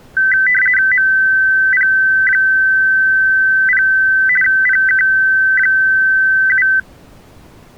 RTTY (50 baud, 450 Hz shift), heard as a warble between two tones, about 1750 Hz centre. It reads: MP0 PK7